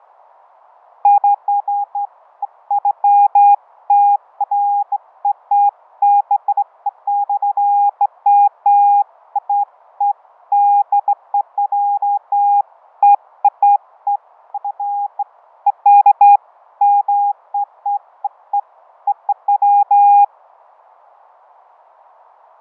Beeps of irregular length, with fading. There is no code.